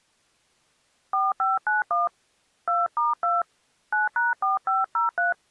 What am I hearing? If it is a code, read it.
DTMF, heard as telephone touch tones, dialled by hand, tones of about 160 ms. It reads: 4591 2*2 9#4503